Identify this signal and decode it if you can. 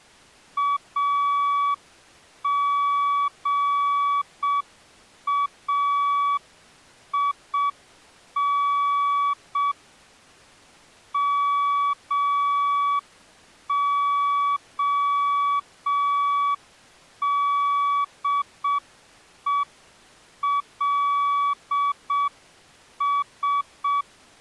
Morse code, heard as a keyed tone, hand-sent with a straight key, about 6 wpm, 1140 Hz. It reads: AGAIN MODELS